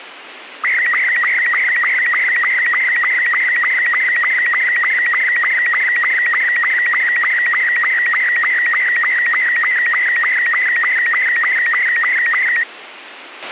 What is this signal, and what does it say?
SSTV (slow-scan television), Robot 72, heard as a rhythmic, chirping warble, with radio hiss and a squelch burst at the end.